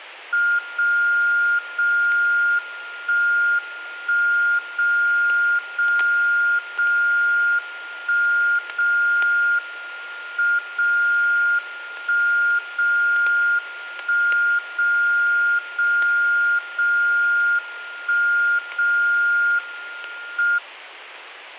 Radio time signal (WWVB), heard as a tone whose level steps once a second, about 1410 Hz, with static crashes. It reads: 0 0 1 1 0 0 0 1 0 M 0 1 0 1 0 0 0 1 0 M